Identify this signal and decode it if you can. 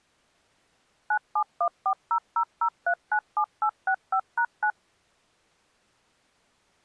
DTMF, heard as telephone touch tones, dialled by machine, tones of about 80 ms. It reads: 9714000397865#9